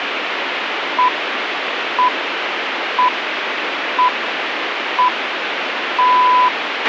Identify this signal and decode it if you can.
Radio time signal (six pips, as the Greenwich Time Signal), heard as pips, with radio hiss and a squelch burst at the end.